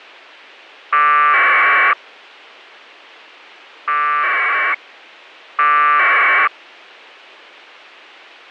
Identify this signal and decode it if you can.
Packet radio (AX.25, as in APRS), 1200 baud, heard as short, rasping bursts.